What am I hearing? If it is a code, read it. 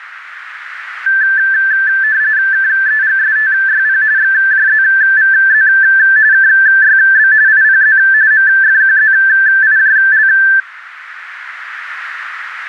RTTY (45.45 baud, 170 Hz shift), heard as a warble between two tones, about 1650 Hz centre, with radio static. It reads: KEGSTYP XJZVZ KYB IPZ MFQZIJL